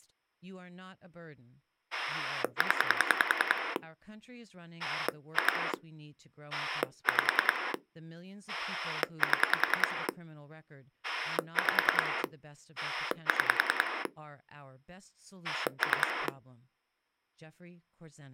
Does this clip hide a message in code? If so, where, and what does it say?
Yes: pulse dialling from 1.9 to 16.3 s, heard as a rotary dial, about 10 pulses a second, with speech in English. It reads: 0 2 5 7 5 6 3